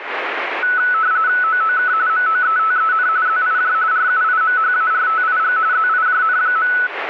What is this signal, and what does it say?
RTTY (45.45 baud, 170 Hz shift), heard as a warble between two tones, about 1390 Hz centre, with radio static. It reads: OOK MOETEN ZIJ RUIMHARTIG ZIJN.